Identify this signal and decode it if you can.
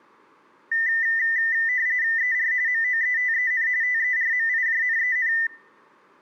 RTTY (45.45 baud, 170 Hz shift), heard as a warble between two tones, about 1900 Hz centre. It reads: ER MOETEN TERMIJNEN